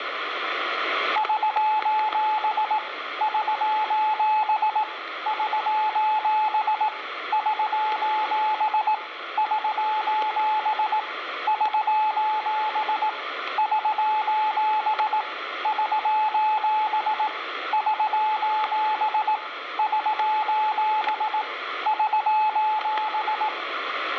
Morse code, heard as a keyed tone, hand-sent with a paddle, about 18 wpm, 860 Hz, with static crashes and room echo. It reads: <SOS> <SOS> <SOS> <SOS> <SOS> <SOS> <SOS> <SOS> <SOS> <SOS> <SOS>